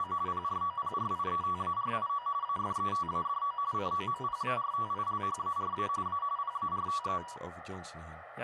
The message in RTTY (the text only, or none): … PROPRIETARIO AFETADO COMPARTILHARA A PARTE